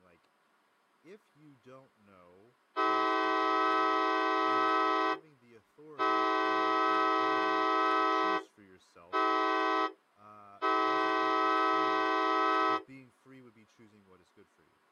Train horn signal, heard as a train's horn, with speech in English. 2 long, 1 short, 1 long. On North American railways: approaching a public crossing.